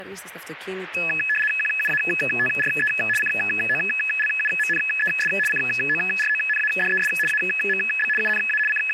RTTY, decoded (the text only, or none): QUATRE COLUMNES CORONADES AMB UNA …